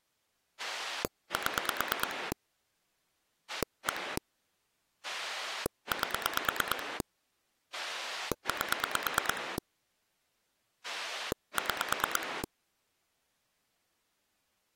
Pulse dialling, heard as a rotary dial, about 9 pulses a second. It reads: 7 1 8 8 6